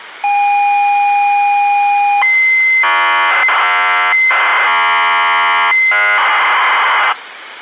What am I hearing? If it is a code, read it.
ZX Spectrum tape loading, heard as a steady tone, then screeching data.